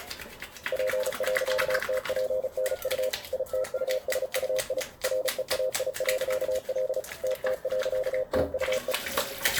Morse code, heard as a keyed tone, machine-sent, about 35 wpm, 520 Hz, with the noise of a restroom. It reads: P.TPNU ITUSUI REAI.L TT.TUE